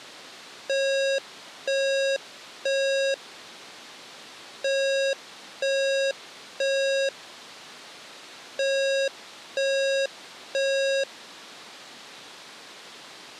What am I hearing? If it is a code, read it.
Alarm pattern, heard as an alarm's beeps, played three times, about 540 Hz. Temporal three. Smoke or fire, evacuate.